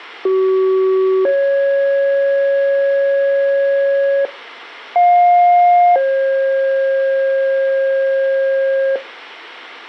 Two-tone page, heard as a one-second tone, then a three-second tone, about 380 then 550 Hz, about 710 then 540 Hz.